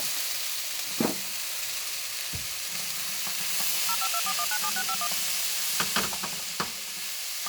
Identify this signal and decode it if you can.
DTMF, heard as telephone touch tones, dialled by machine, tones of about 60 ms, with kitchen noise. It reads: 0524197651